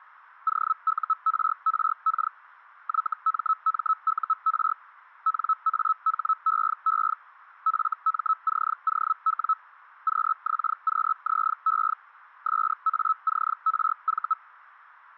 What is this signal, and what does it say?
Hellschreiber (Feld-Hell, 122.5 baud), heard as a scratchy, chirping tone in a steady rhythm, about 1300 Hz. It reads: OURRK YMMUR NAHEE FMCOW QXQZE SACRV